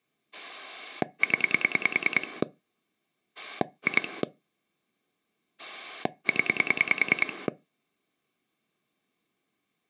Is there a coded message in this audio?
Yes: pulse dialling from 0.3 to 7.5 s, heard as a rotary dial, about 10 pulses a second. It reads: 0 2 0